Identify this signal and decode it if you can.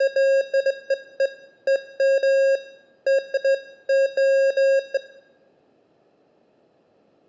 Beeps of irregular length, with room echo. There is no code.